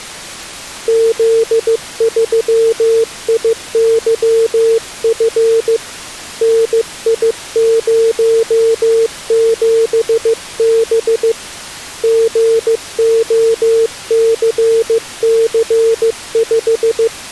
Morse code, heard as a keyed tone, hand-sent with a paddle, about 15 wpm, 450 Hz. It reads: Z3IYF NI07B GOCC5